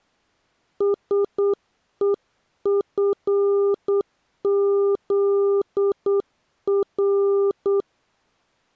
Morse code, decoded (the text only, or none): SEFZR